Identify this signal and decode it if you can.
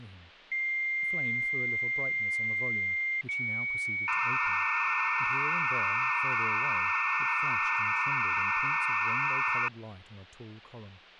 Dial-up modem handshake (low-speed, two carriers), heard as two whistles, then hiss, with speech in English.